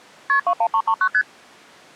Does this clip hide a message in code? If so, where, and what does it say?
Yes: multi-frequency trunk signalling (R1, as on North American trunks) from 0.3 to 1.2 s, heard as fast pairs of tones, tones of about 70 ms. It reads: KP 21339 ST